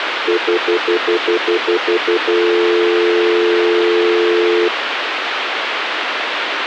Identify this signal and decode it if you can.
Telephone call progress tone (North American plan), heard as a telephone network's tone, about 350, 440 Hz, 0.1 s on and 0.1 s off, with phone line noise. Stutter dial tone.